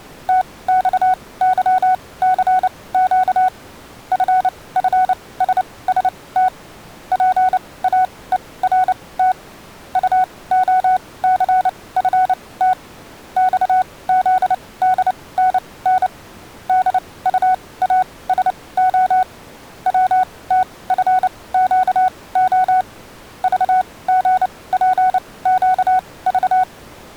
Morse code, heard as a keyed tone, machine-sent, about 29 wpm, spaced as for 20 wpm, 740 Hz. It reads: TXYCQ FFSST PAERT UOCFT XZDNN DUASO WTFQO VGPQV